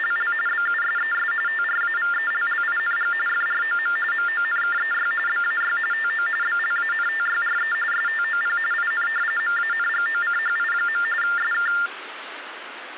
TTY/TDD text telephone tones (45.45 baud Baudot), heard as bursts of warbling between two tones, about 400 Hz shift, 1600 Hz centre, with phone line noise. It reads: … BUSES TRAVELLING FROM MONKEY BAY TO BLANTYRE STOP IN MANGOCHI. SK